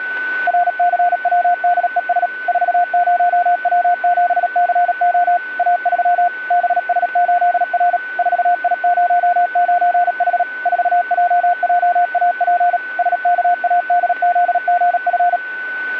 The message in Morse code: RCWDES 40W7CO A3 BS8R 4I09H 4JJAP SKADZGF

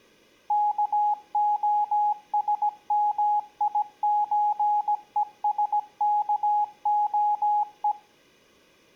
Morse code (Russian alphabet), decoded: КОСМИЧЕСКОЕ

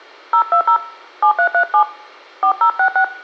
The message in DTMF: 020 7337 4066

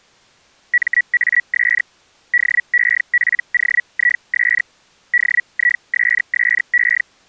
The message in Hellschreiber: MAS DEPOIS DISSE

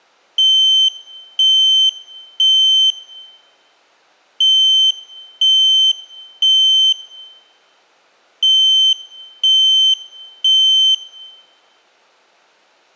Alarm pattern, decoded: temporal three

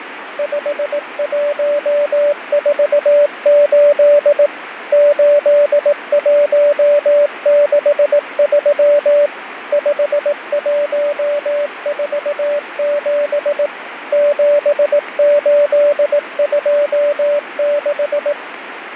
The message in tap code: none

